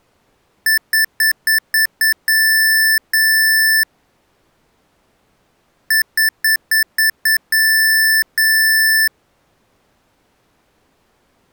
Beep code, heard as beeps from a small speaker, played twice, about 1750 Hz. 6 short, 2 long.